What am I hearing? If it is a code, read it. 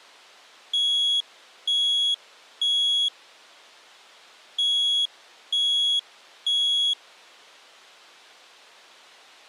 Alarm pattern, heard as an alarm's beeps, played twice, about 3350 Hz. Temporal three. Smoke or fire, evacuate.